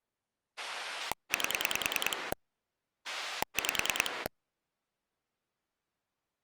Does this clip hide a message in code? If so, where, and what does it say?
Yes: pulse dialling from 0.6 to 4.3 s, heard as a rotary dial, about 10 pulses a second. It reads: 8 5